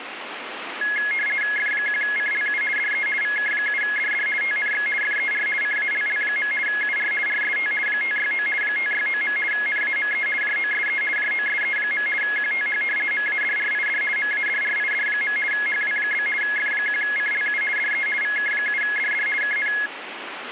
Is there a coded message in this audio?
Yes: RTTY (50 baud, 450 Hz shift) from 0.8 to 19.9 s, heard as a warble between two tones, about 1900 Hz centre, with radio static. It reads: F1CLU DE VK7DD TNX FER CALL. UR RST 569 569. NAME JOSE JOSE. QTH MADRID MADRID. HW? F1CLU DE VK7DD KN